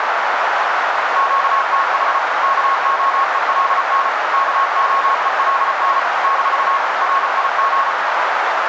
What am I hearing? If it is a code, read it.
Morse code, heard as a keyed tone, machine-sent, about 34 wpm, 1090 Hz, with heavy radio static and a narrow filter. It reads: QTH KOELN KOELN - RIG